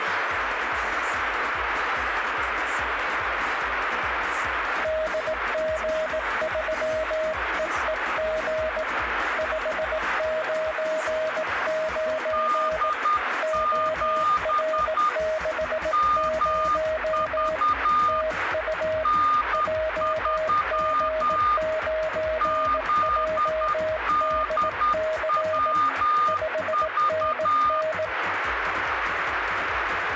Morse code, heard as two keyed tones, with radio static. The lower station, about 18 wpm, 630 Hz: DG3EEG 599 OR60 TU JG9JDC 5NN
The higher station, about 10 wpm, 1220 Hz: D7 MV N3 ZDWV